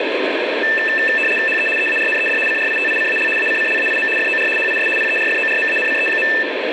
RTTY (75 baud, 850 Hz shift), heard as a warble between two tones, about 2200 Hz centre, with radio static. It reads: HE EARNED CRITICAL ACCLAIM FOR HIS PERFORMANCE.